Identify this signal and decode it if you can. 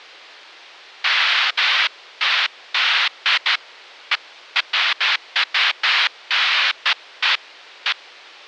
Bursts of noise. There is no code.